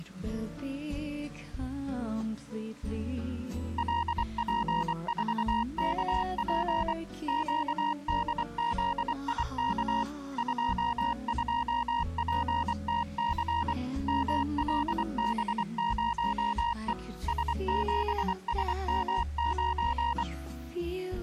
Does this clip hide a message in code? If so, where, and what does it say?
Yes: Morse code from 3.7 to 20.3 s, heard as a keyed tone, machine-sent, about 24 wpm, 940 Hz. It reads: LP4KP QDZIK 22PTC MLB0E S7SM9